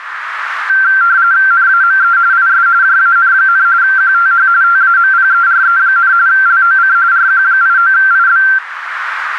RTTY (45.45 baud, 170 Hz shift), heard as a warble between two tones, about 1470 Hz centre, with radio static and a narrow filter. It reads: NAME IS JAN, QTH TAMPERE, LOC RQ89IB